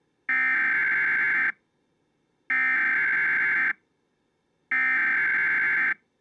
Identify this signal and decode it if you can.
Emergency Alert System (SAME) tones (header bursts), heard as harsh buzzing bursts, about 520.83 baud.